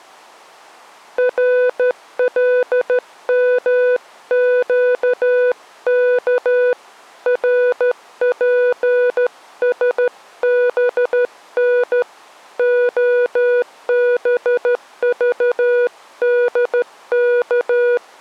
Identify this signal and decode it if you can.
Morse code, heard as a keyed tone, hand-sent with a straight key, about 13 wpm, 490 Hz. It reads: RLMQK RPSBN OBVDK